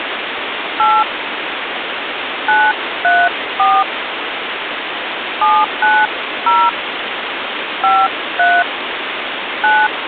DTMF, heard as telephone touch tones, dialled by hand, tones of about 230 ms, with phone line noise. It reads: 8 934 790 53 9